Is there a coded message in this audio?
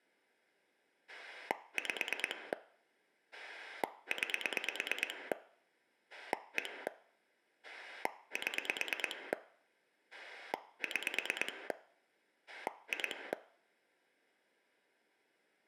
Yes: pulse dialling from 1.1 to 13.3 s, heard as a rotary dial, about 9 pulses a second, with room echo. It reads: 5 9 1 7 6 2